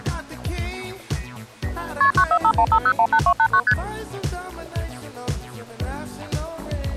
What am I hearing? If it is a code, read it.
Multi-frequency trunk signalling (R1, as on North American trunks), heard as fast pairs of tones, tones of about 70 ms. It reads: KP 94515018289 ST